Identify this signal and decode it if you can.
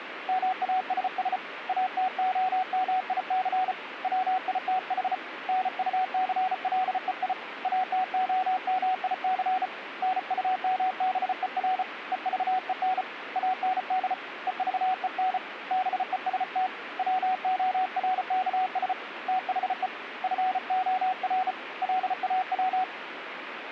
Morse code, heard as a keyed tone, hand-sent with a bug key, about 34 wpm, 750 Hz, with radio static. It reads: MASS ATOMIC WITH NUCLEI ATOMIC NUMBER EVEN AND EVEN BEST WORKS THE FOR LAW